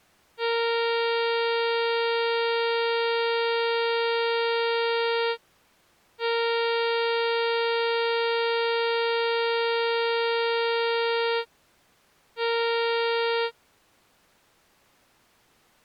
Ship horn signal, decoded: 2 long, 1 short

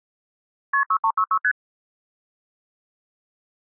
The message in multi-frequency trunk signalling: KP 6366 ST

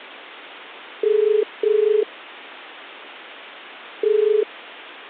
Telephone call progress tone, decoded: ringback tone

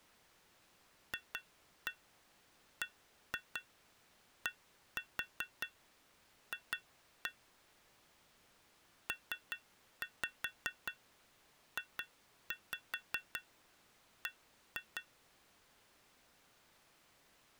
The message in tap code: FBDF PJB

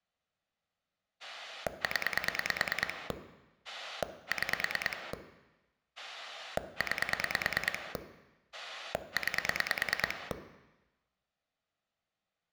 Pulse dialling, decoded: 0 6 9 9

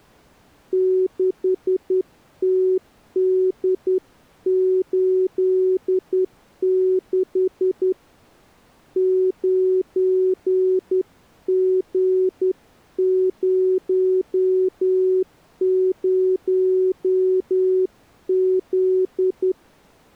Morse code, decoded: 6TD86 9G00Z

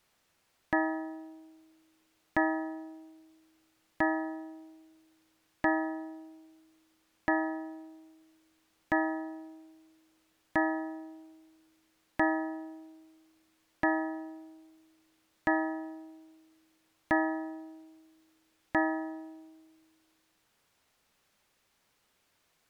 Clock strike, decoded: 12

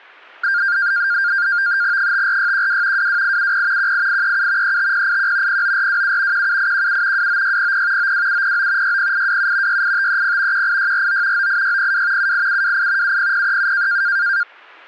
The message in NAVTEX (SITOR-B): 54612 22870 18837 35081 09427 17817 29600 92709 60827 68530 18649 98602 78728 70037

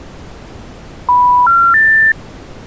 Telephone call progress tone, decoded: special information tone

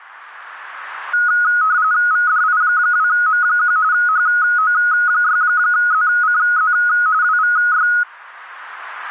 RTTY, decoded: VDI2M1 HO6ZCZ WVY

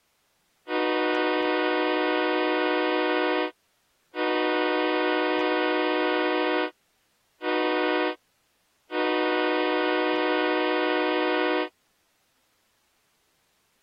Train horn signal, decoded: 2 long, 1 short, 1 long

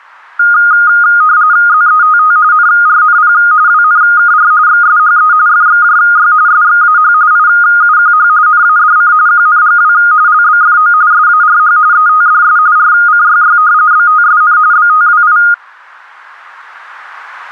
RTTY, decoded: ZETT NRNP WNKR XSHE FXJY SXAH IUQH NADC QNGW LBFO SARH ETDS RCYY BTSN BTWI

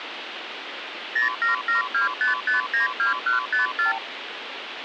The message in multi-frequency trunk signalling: 07725592154

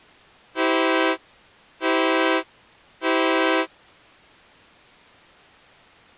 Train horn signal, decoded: 3 short

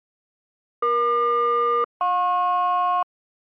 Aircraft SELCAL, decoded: EQ-JP

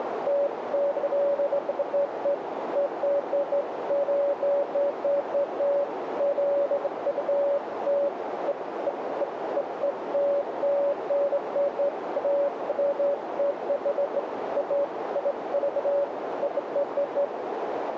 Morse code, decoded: none

